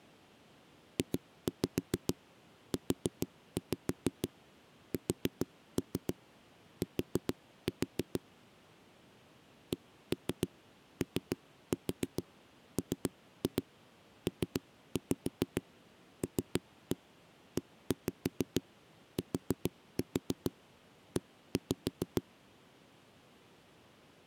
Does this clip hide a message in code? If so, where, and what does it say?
Yes: tap code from 1.0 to 22.2 s, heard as knocks on a wall, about 6 knocks a second. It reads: JUST COMPLETE